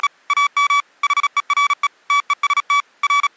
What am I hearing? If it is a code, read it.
Morse code, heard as electronic beeps, machine-sent, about 36 wpm, 1140 Hz. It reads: … AM HERE TEST …